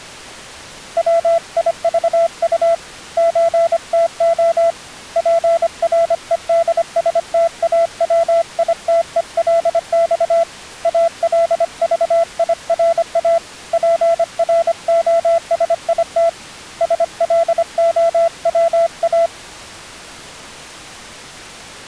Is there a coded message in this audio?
Yes: Morse code (Russian alphabet) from 0.9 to 19.3 s, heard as a keyed tone, hand-sent with a paddle, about 25 wpm, 670 Hz. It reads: ВИЖУ ЧТО ПРЕДСТАВИТЕЛЬ АЛЖИРА ПРОСИТ СЛОВА